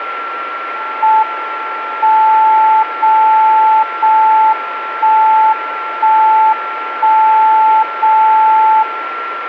Radio time signal (JJY), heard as a tone whose level steps once a second, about 880 Hz, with radio static and a steady whistle near 1360 Hz. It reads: M 0 0 1 1 1 0 0